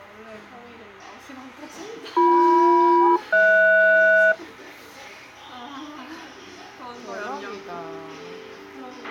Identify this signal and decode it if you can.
Aircraft SELCAL, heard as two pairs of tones, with a squelch burst at the end and the noise of a restaurant. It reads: BM-HS